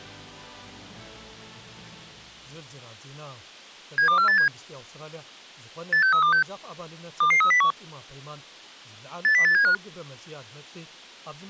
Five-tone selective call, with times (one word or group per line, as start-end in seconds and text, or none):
4.0-4.5 72487
5.9-6.4 86326
7.2-7.7 22301
9.2-9.7 80875